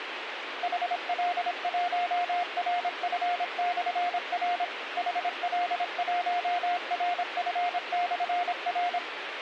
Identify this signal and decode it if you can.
Morse code, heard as a keyed tone, machine-sent, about 26 wpm, 710 Hz, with radio hiss. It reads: HL1RF/R HL1RF/R